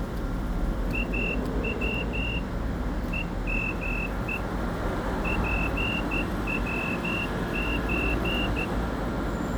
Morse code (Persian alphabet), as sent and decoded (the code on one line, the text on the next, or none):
.- .-- / . -- . / .--. .-- ---.
او همه پوچ